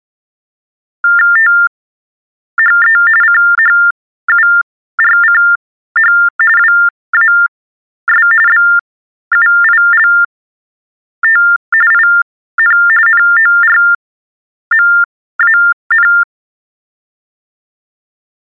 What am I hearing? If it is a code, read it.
TTY/TDD text telephone tones (45.45 baud Baudot), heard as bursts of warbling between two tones, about 400 Hz shift, 1600 Hz centre. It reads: THE CHURCH WAS BUILT IN NORMAN